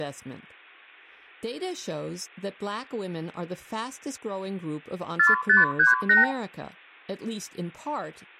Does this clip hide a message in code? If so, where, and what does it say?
Yes: multi-frequency trunk signalling (R2, with the far end's replies) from 5.2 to 6.3 s, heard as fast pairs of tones, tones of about 150 ms, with room echo. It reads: 4538